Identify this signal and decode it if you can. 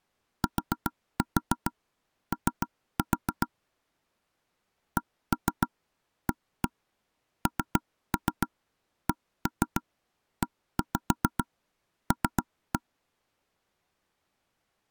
Tap code, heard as taps on a table, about 7 knocks a second. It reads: TO CANCEL